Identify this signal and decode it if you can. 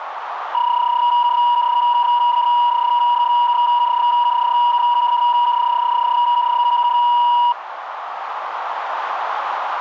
PSK31 (31.25 baud), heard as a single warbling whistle, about 960 Hz, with radio static and a narrow filter.